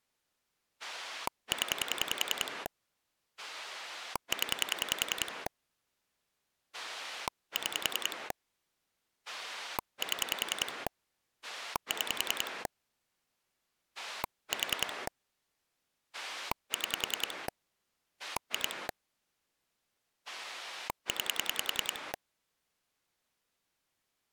Pulse dialling, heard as a rotary dial, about 10 pulses a second. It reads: 0 0 6 7 6 4 6 2 9